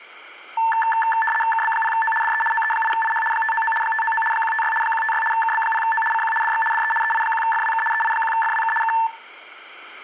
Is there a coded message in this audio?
Yes: RTTY (75 baud, 850 Hz shift) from 0.6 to 9.1 s, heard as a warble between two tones, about 1330 Hz centre, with static crashes. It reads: KB0O DE OE8IH 599 599 156 156 KB0O CQ DX DE EI1FWK EI1FWK K